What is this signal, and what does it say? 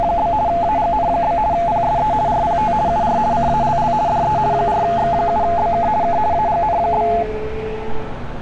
RTTY (50 baud, 170 Hz shift), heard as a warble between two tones, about 770 Hz centre, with street noise. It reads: … AGN? PSE RPT UR CALL DE 4X7BK K AGN?